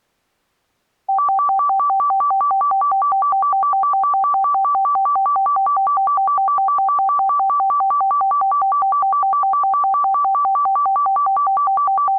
A tone that alternates evenly between two pitches. There is no code.